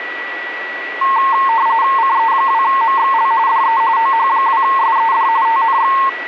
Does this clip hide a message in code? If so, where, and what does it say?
Yes: RTTY (45.45 baud, 170 Hz shift) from 1.0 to 6.1 s, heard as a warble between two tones, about 990 Hz centre, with radio static and a steady whistle near 1940 Hz. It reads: CE2MXL DE OH2SED TNX